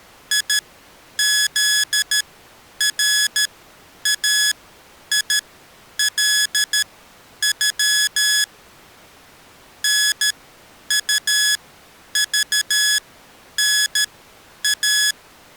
Morse code (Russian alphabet), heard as electronic beeps, machine-sent, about 13 wpm, spaced as for 9 wpm, 1700 Hz. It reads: ИЗРАИЛЮ НУЖНА